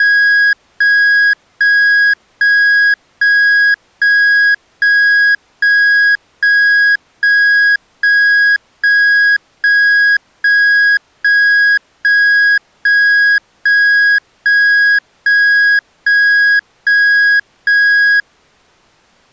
Evenly repeated beeps. There is no code.